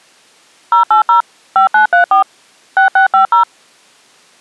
DTMF, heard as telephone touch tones, dialled by machine, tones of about 120 ms. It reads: 080 5934 6650